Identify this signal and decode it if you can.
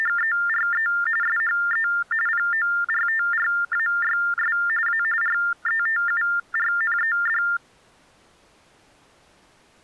TTY/TDD text telephone tones (45.45 baud Baudot), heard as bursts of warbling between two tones, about 400 Hz shift, 1600 Hz centre. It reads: … SHE PORTRAYS A RETURNED